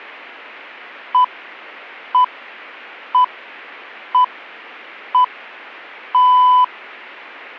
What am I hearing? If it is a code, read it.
Radio time signal (six pips, as the Greenwich Time Signal), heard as pips.